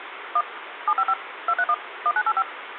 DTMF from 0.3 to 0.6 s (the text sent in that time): 1